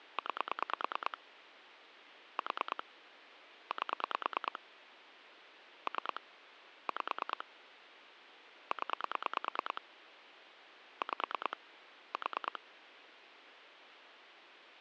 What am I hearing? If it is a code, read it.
Pulse dialling, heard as clicks on a phone line, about 9 pulses a second, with phone line noise. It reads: 9 4 8 3 5 0 5 4